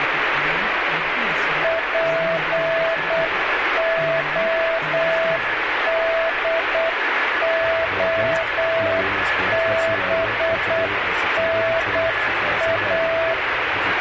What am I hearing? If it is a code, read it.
Morse code, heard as a keyed tone, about 8 wpm, 660 Hz, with radio static and a weaker station near 1710 Hz. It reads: PODOBNA